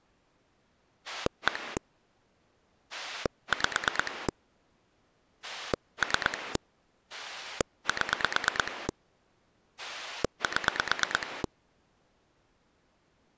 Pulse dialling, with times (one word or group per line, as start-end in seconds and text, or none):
1.1-1.8 1
2.9-4.3 5
5.4-6.6 3
7.1-8.9 7
9.8-11.4 7